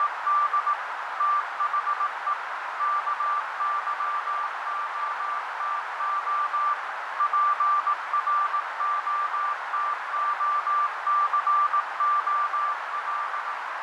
Morse code, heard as a keyed tone, machine-sent, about 18 wpm, 1180 Hz, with heavy radio static, fading and a narrow filter. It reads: … THE KYOTO PROTOCOL